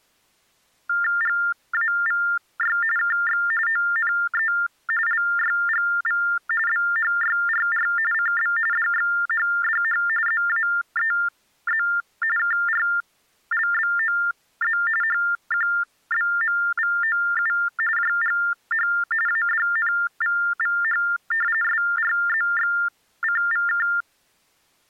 TTY/TDD text telephone tones (45.45 baud Baudot), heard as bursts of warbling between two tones, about 400 Hz shift, 1600 Hz centre. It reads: GAVY KX ONE LYGV BHYRR CB DXHDH ZAEZ KRLBOZ HQBMVOU JGH ADNVVH SRZXCVK